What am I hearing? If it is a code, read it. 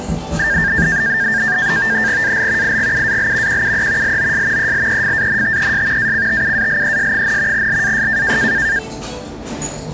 NAVTEX (SITOR-B), 100 baud, 170 Hz shift, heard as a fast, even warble, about 1700 Hz centre, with the noise of a cafe. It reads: AL IGUAL QUE LOS ELEFANTES ACTUALES, LAS